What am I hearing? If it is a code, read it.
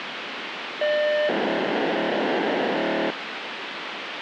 POCSAG pager data (1200 baud), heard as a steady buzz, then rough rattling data, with radio hiss.